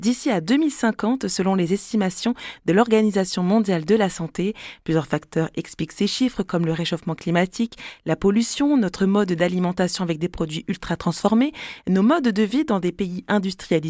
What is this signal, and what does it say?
Speech in French. There is no code.